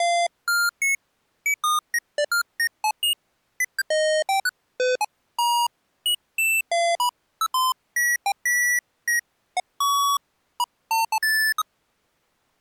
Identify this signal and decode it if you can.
Electronic bleeps of random pitch and length. There is no code.